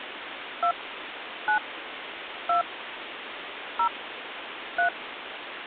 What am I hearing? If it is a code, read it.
DTMF, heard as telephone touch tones, dialled by hand, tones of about 100 ms, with phone line noise. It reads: 2 9 2 0 3